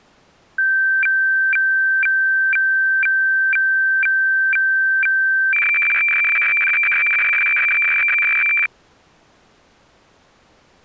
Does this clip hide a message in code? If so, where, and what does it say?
Yes: weather fax (radiofax), 120 lines a minute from 0.6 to 8.7 s, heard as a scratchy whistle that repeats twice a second.